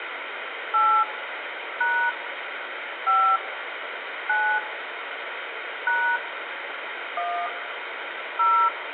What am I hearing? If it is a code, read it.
DTMF, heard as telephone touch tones, dialled by hand, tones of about 290 ms, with phone line noise and room echo. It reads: 8 # 5 9 # 1 0